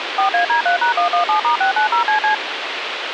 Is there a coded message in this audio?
Yes: DTMF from 0.2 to 2.3 s, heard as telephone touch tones, dialled by machine, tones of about 110 ms, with radio hiss. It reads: 4AD3#117*690CC